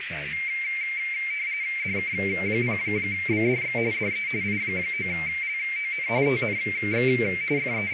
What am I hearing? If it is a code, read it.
RTTY (45.45 baud, 170 Hz shift), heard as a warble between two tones, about 2200 Hz centre, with radio static, a narrow filter and speech in Dutch. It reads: DK0BDX DE I9LON TNX …